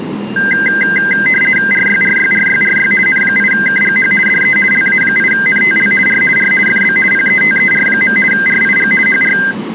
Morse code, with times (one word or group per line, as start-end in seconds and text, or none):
none